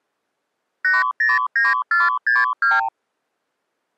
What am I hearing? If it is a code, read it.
Multi-frequency trunk signalling (R2, with the far end's replies), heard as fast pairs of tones, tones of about 180 ms. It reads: 809462